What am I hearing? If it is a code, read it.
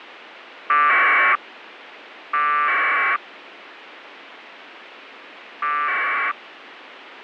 Packet radio (AX.25, as in APRS), 1200 baud, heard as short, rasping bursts, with radio hiss.